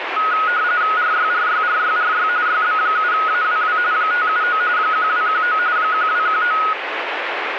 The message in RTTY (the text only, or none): RYRYRYRY YB7AWW 579 1219 1219